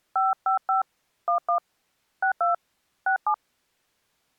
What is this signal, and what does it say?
DTMF, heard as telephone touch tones, dialled by hand, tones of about 130 ms. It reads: 555 11 62 67